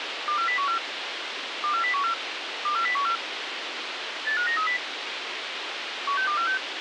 Five-tone selective call (CCIR), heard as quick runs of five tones, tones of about 100 ms, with radio hiss. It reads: 24014 24014 24014 85930 16246